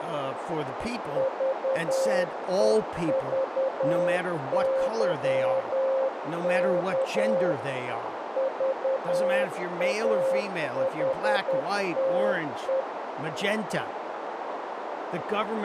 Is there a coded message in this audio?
Yes: Morse code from 1.1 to 12.9 s, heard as a keyed tone, machine-sent, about 10 wpm, 530 Hz, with radio static, a narrow filter and speech in English. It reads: VEVYK VAHTE